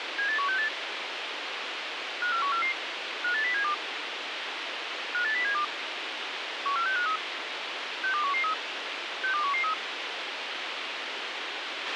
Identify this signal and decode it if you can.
Five-tone selective call (CCIR), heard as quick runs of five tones, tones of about 100 ms, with radio hiss and a squelch burst at the end. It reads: 78168 54144 58072 58072 14653 62113 62113